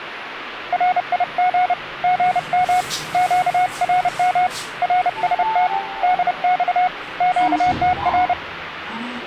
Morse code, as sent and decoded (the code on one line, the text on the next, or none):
.-. .. --. / --. -- / --.- .-. -- / .-. ... - / -.. -..- / --.- - .-.
RIG GM QRM RST DX QTR